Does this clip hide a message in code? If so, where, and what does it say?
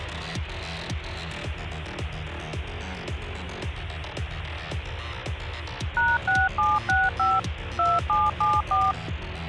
Yes: DTMF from 6.0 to 8.9 s, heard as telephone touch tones, dialled by machine, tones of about 200 ms, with phone line noise. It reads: #6765 2774